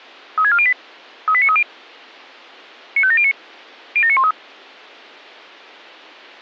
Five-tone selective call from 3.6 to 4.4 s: 07913

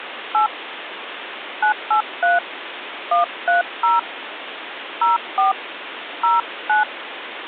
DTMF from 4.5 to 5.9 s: 04

